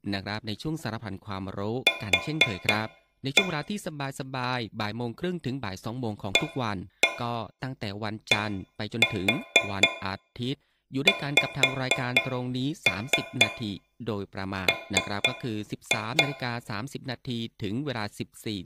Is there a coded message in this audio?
Yes: tap code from 1.9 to 16.3 s, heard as taps on a metal pipe, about 4 knocks a second, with room echo and speech in Thai. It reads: Q ADXM